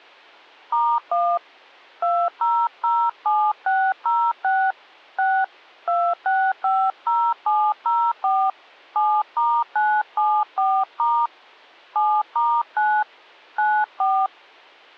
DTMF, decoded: *1 2007606 6 2650704 7*974* 7*9 94

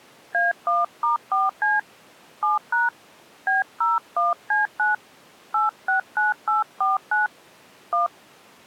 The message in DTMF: A1*4C 7# B01C9 869849 1

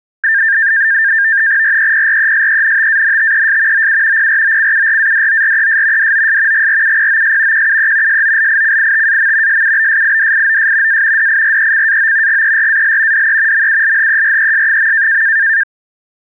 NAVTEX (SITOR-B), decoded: REPRESENTANTES OU PROCURADORES DOS GRUPOS QUE SOLICITAM SUBSIDIOS A DIRECAO GERAL DE MULHERES.

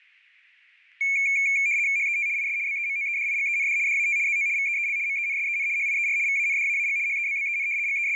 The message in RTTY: HET IS BEMOEDIGEND DAT ZO VEEL MENSEN HIER VANDAAG HEBBEN …

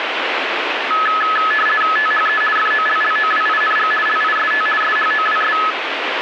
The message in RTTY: THE FOLLOWING LIST SHOWS

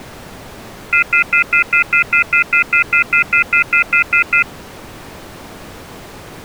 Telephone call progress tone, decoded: off-hook warning tone

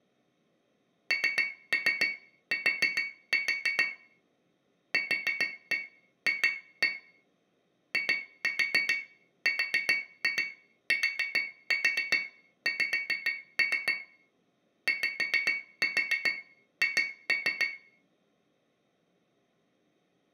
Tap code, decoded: NT QF IRTX YH

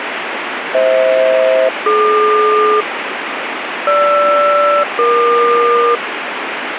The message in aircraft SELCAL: FH-DQ GR-EQ

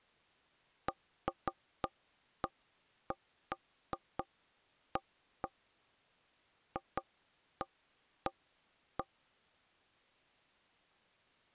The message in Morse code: none

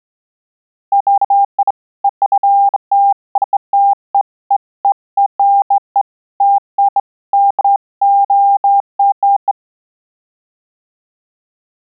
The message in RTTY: none

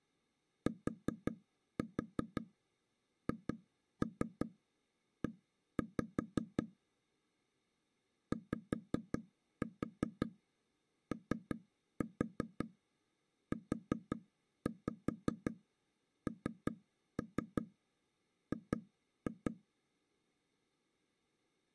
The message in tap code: THE YOUNG

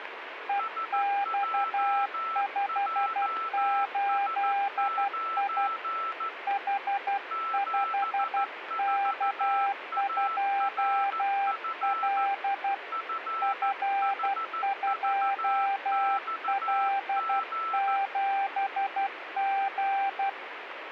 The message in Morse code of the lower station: EX58I H5K2L F2L7G

